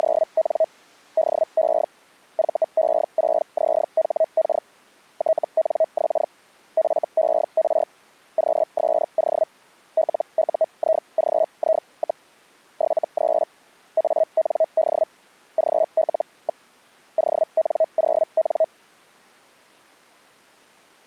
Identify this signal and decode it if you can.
Hellschreiber (Feld-Hell, 122.5 baud), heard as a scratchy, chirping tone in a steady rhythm, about 640 Hz. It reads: … DE VE6ZHK TNX FER QSO LUIGI, 73 AND GL. ON0N